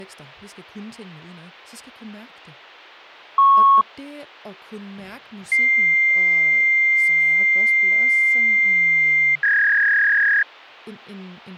Fax machine handshake, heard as a beep, a long tone and a warble, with hum and speech in Danish.